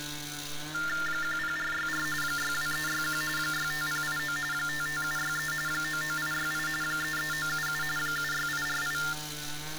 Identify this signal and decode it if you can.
TTY/TDD text telephone tones (45.45 baud Baudot), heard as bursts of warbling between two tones, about 400 Hz shift, 1600 Hz centre, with street noise. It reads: 10464 62361 65089 55763 99868 33977 76848